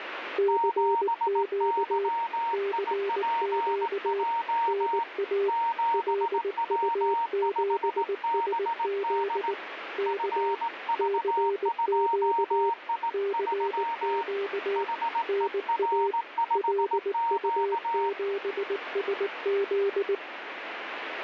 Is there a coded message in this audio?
Yes: Morse code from 0.3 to 20.2 s, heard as two keyed tones, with radio static. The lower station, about 19 wpm, 400 Hz: CQ CQ NA LU7SZ K CQ CQ NA LU7SZ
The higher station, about 18 wpm, 930 Hz: 7YIPJ 7W5BD FV2I3 HER5Q